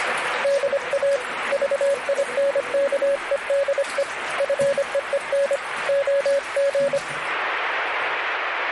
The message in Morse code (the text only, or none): DA VINKEDE FEEN OG